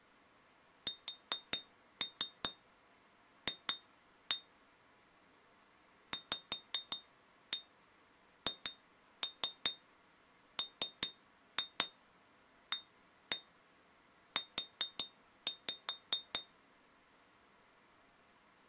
Tap code, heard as taps on glass, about 5 knocks a second. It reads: SF VHMAU